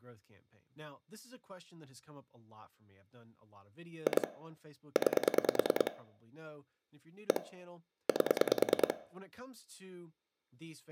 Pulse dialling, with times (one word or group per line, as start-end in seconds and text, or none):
4.1-4.3 2
5.0-5.9 9
7.3-7.4 1
8.1-8.9 8